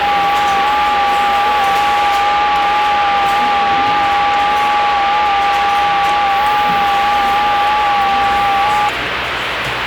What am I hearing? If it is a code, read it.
FT8 (several signals at once), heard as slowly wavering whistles, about 6.25 baud, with radio static and the noise of a restaurant.